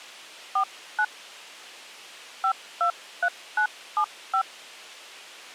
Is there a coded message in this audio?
Yes: DTMF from 0.6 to 4.4 s, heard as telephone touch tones, dialled by hand, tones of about 80 ms. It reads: 49 523975